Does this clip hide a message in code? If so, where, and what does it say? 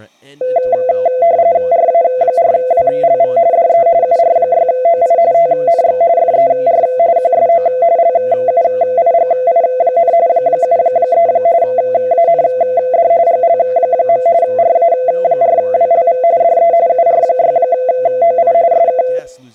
Yes: RTTY (45.45 baud, 170 Hz shift) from 0.4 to 19.2 s, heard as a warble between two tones, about 590 Hz centre, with speech in English. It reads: RA4WLV DE UR6OI TNX FER QSO LUIGI, 73 AND GL. RA4WLV DE UR6OI SK